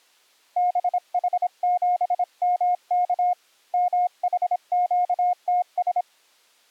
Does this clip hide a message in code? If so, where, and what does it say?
Yes: Morse code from 0.5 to 6.1 s, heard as a keyed tone, hand-sent with a paddle, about 26 wpm, 720 Hz. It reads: BH7MK MHQTS